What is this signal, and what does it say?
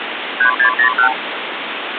Multi-frequency trunk signalling (R2, with the far end's replies), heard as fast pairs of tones, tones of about 100 ms, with phone line noise. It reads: 3601